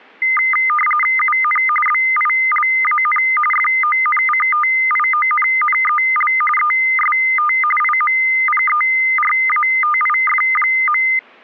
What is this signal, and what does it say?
RTTY (45.45 baud, 850 Hz shift), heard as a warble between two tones, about 1650 Hz centre. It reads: UN BILAN FONCTIONNEL EST IMPERATIF.